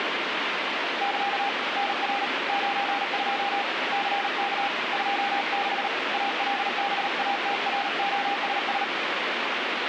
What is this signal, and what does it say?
Morse code, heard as a keyed tone, hand-sent with a paddle, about 38 wpm, 800 Hz, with radio static. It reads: <KA> NR 92 CK 26 ALBATROSS